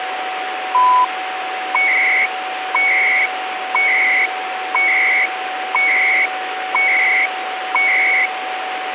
Radio time signal (CHU, Canada), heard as beeps and data bursts, one a second, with radio static and a steady whistle near 750 Hz.